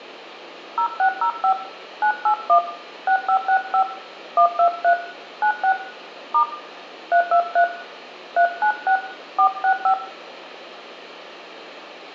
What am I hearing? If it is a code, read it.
DTMF, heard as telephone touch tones, dialled by hand, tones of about 90 ms, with room echo. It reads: 0605 981 6565 123 96 * 323 396 465